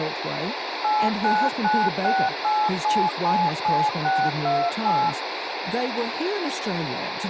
DTMF, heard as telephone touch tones, dialled by machine, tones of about 240 ms, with radio hiss. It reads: 89968777628